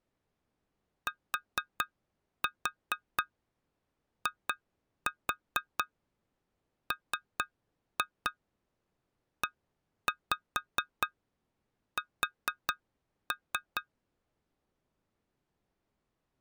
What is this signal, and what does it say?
Tap code, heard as taps on glass, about 4 knocks a second. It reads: TIMES